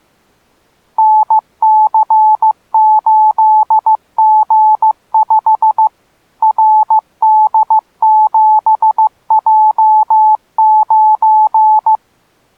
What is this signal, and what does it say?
Morse code, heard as a keyed tone, machine-sent, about 15 wpm, 860 Hz. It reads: NC8G5 RD7J9